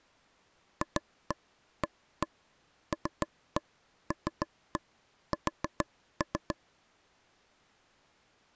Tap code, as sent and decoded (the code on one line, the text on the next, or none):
2-1 1-1 3-1 3-1 4-3
FALLS